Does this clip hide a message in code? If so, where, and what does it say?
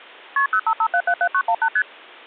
Yes: multi-frequency trunk signalling (R1, as on North American trunks) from 0.4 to 1.8 s, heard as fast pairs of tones, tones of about 70 ms. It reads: KP 055777918 ST